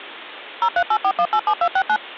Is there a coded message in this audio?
Yes: DTMF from 0.6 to 2.0 s, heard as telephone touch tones, dialled by machine, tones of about 70 ms. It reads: 0384187269